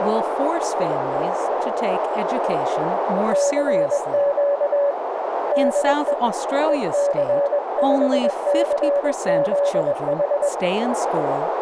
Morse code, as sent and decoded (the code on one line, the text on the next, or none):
-.-. --.- / -.. . / . -.-. ..... -.-. --.. ....
CQ DE EC5CZH